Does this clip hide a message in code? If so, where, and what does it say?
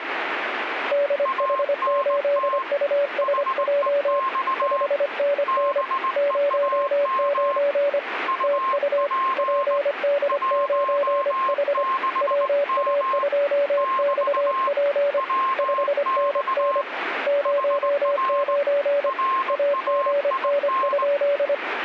Yes: Morse code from 0.9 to 21.6 s, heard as two keyed tones, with radio static. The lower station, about 25 wpm, 570 Hz: DH8USJ 5NN 09 TU PD9H WA2XP 5NN 09 AGN?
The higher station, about 19 wpm, 1060 Hz: ANT HEX BEAM UP 16M <BT> WX HR RAIN